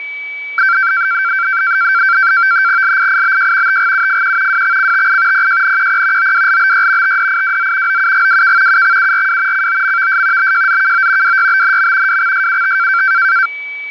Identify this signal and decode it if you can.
NAVTEX (SITOR-B), 100 baud, 170 Hz shift, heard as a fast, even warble, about 1460 Hz centre, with a steady whistle near 2290 Hz. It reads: LIIBJ TGUFQ WXCTI PJNQP OWLBY TDIWZ OUGWK UXURW COMVS BJZKO WYBNM WXSUT